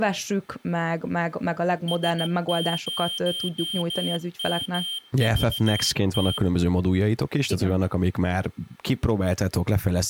Morse code, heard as a high beeper, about 15 wpm, 3150 Hz, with room echo and speech in Hungarian. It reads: S0MVT